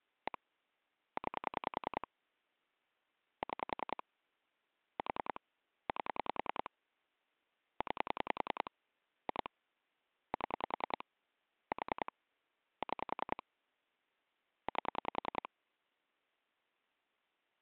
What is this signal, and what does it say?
Pulse dialling, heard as clicks on a phone line, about 10 pulses a second. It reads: 1 9 6 4 8 9 2 7 4 6 8